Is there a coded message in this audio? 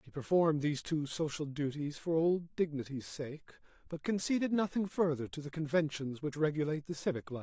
No, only speech in English.